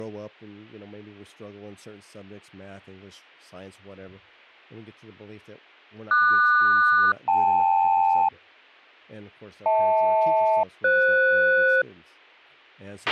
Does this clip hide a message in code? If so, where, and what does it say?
Yes: aircraft SELCAL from 6.1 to 11.8 s, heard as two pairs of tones, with a squelch burst at the end and speech in English. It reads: QS-KL HL-FS